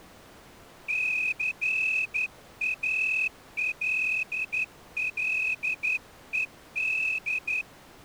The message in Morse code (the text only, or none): CALLED